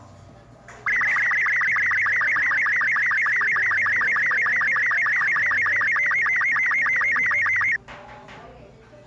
SSTV (slow-scan television), Robot 36, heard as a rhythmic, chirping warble, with the noise of a cafe.